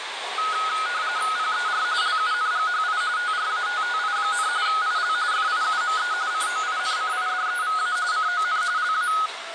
RTTY (45.45 baud, 170 Hz shift), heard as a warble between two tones, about 1360 Hz centre, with radio static and the noise inside a subway train. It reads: PER LUNGHI TRATTI, IL FIUME COINCIDEVA CON LA